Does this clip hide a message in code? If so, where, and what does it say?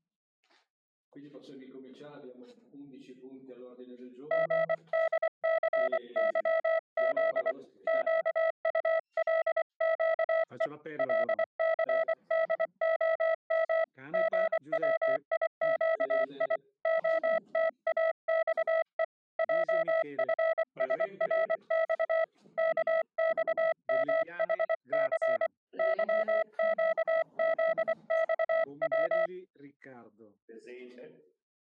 Yes: Morse code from 4.3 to 29.3 s, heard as a keyed tone, hand-sent with a paddle, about 24 wpm, 650 Hz. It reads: GDCYZ QULQE LCDOM GWIQI OTAXE JFSRX KXMHC YQZXW